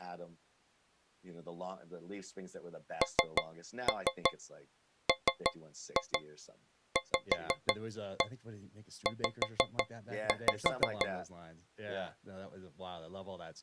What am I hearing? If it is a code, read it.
Tap code, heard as taps on a metal pipe, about 6 knocks a second, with speech in English. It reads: NMVZ